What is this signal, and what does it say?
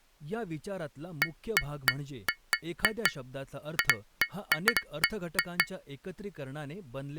Irregular taps on glass, with speech in Marathi. There is no code.